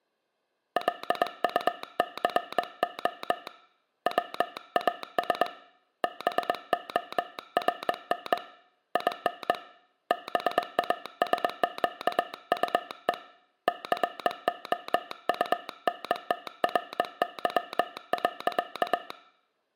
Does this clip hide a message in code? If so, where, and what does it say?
Yes: Morse code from 0.7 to 19.2 s, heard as a telegraph sounder, hand-sent with a bug key, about 21 wpm. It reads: LUCO WAS BORN IN BASQUE COUNTRY.